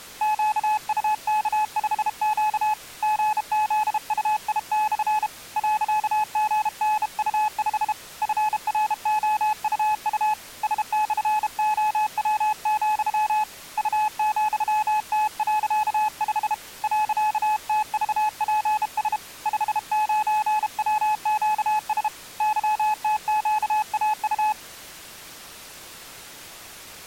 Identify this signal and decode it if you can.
Morse code, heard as a keyed tone, hand-sent with a bug key, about 32 wpm, 850 Hz. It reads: QUK5Q GZUI/ .GNU5 FROUU S/OW, U,T.5 .TVPS 59WQS YTQAU